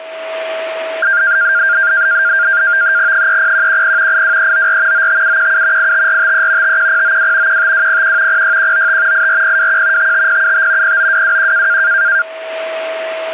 NAVTEX (SITOR-B), 100 baud, 170 Hz shift, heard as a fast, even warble, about 1500 Hz centre, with a steady whistle near 650 Hz. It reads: 30110 82394 95717 85453 51092 15201 06195 84021 55075 09221